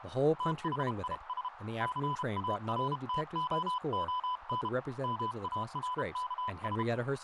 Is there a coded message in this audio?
Yes: Morse code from 0.3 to 6.9 s, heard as a keyed tone, hand-sent with a paddle, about 32 wpm, 1000 Hz, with radio static, a narrow filter and speech in English. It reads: THIS CARTOON MARKS